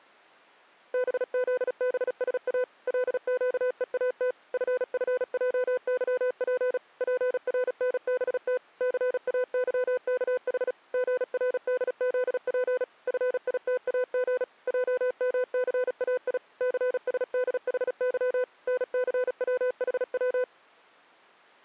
Morse code, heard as a keyed tone, machine-sent, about 36 wpm, 500 Hz. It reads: BZBSA LQEAT FFJYP PRNBT CAYKH GRDZP FITAG JMCAI CSDHY NCWHW